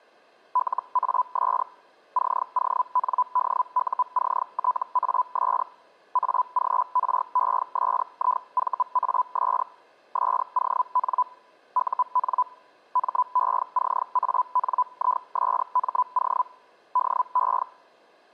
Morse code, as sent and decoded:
none

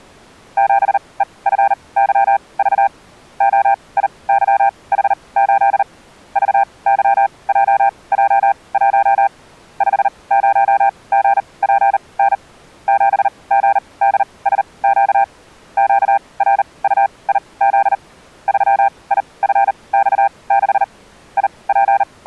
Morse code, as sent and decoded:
--... . ..-. -.-- ...- / --- .. -.-- .... ---.. / ...- -.-- .--- .--- .---- / ..... ----- --. .--. -. / --... --. -.. ... --.- / --.- .-. ..- .. --.. / ...-- .. ..-. -..- -.... / …
7EFYV OIYH8 VYJJ1 50GPN 7GDSQ QRUIZ 3IFX6 …

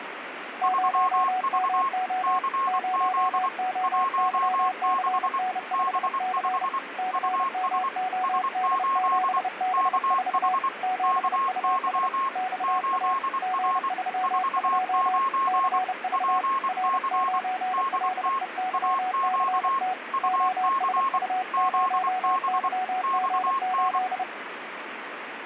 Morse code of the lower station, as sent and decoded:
----- -- --- / ----- --- -.-- -.-. -. ..... -.-. / -.-. -- --- -.. --... -... ....- / --... ..- ... / -..- .- / --. ...-- ..--- / -.-. ...- / .-. ----. .-.. . -.-- -.-. - / --- ... ..- ----- -.-- --. ---..
0MO 0OYCN5C CMOD7B4 7US XA G32 CV R9LEYCT OSU0YG8

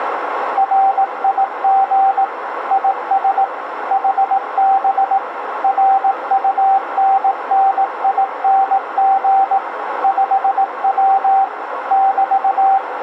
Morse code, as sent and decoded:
.-. .. --. / .. ... / .... -... / .-. ..- -. -. .. -. --. / ..... .-- / -...-
RIG IS HB RUNNING 5W <BT>

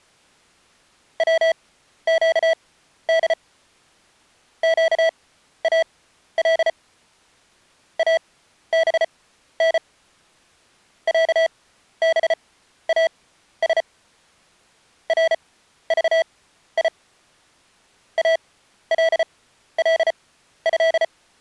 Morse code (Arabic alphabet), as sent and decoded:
.-- --.- -.. / --.- .- .-.. / .- -... -. / .-.- -... .- ... / .-. ...- .. / .- .-.. .-.. ..-..
وقد قال ابن عباس رضي الله

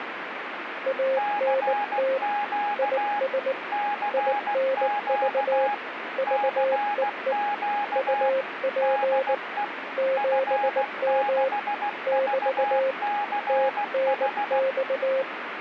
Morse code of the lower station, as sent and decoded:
.- -. - / .. ... / .. -. ...- / ...- . . / ..- .--. / --... -- / -...- / - -. -..-
ANT IS INV VEE UP 7M <BT> TNX

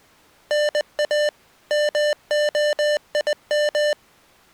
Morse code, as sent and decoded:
-. .- / -- --- .. --
NA MOIM

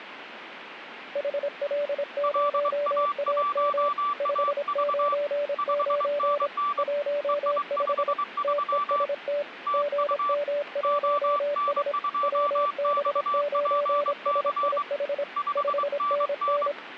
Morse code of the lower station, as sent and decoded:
.... .-.. ----- .- -- / ..... ----. ----. / .---- ..... / - . ... - / --. -- .---- ... / .-- -... ----. ... .. .... / ..... -. -.
HL0AM 599 15 TEST GM1S WB9SIH 5NN

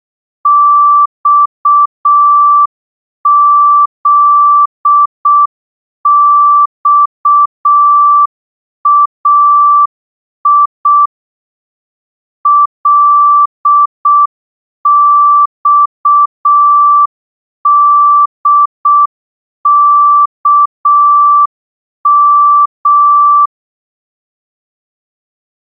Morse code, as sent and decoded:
-..- --.. -..- .- .. / .-.. -..- -.. -.- --
XZXAI LXDKM

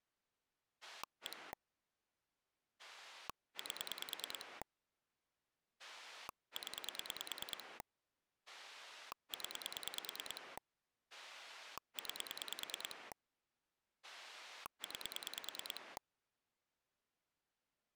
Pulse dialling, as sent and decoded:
1 / 8 / 10 / 10 / 9 / 9
1 8 0 0 9 9

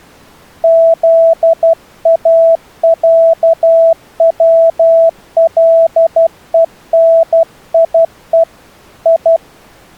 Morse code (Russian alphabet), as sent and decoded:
--.. .- .-.- .-- .-.. . -. .. . / ..
ЗАЯВЛЕНИЕ И

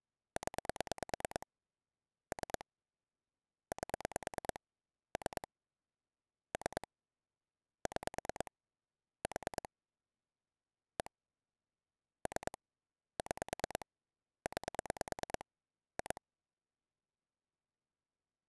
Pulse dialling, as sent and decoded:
10 / 3 / 8 / 3 / 3 / 6 / 4 / 1 / 3 / 6 / 9 / 2
0 3 8 3 3 6 4 1 3 6 9 2

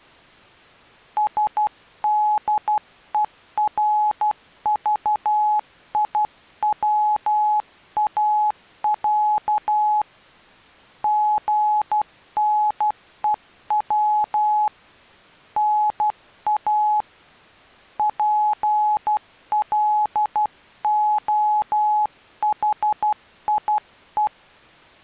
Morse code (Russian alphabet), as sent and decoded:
... -.. . .-. ...- .. .-- .- .-.- / --. -. . .-- / -. .- / .--. .-.. --- .... .. .
СДЕРЖИВАЯ ГНЕВ НА ПЛОХИЕ

